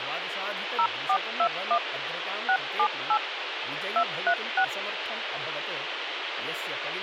DTMF, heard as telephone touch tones, dialled by machine, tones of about 70 ms, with phone line noise and speech in Sanskrit. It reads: 0421 678 236